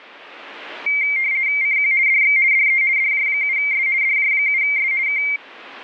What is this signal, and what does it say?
RTTY (50 baud, 170 Hz shift), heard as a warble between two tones, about 2200 Hz centre. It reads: CQ DX DE DJ7S DJ7S K